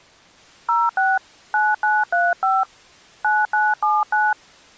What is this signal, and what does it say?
DTMF, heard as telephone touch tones, dialled by hand, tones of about 210 ms. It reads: 06 9935 9979